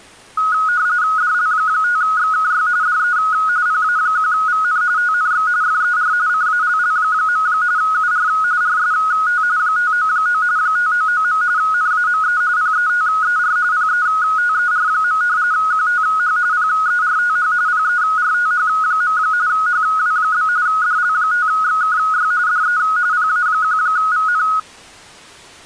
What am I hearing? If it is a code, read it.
RTTY (45.45 baud, 170 Hz shift), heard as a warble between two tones, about 1360 Hz centre. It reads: DL5XKY DE PA1VN TNX FER CALL. UR RST 599 599. NAME PETER PETER. QTH PERTH PERTH. HW? DL5XKY DE PA1VN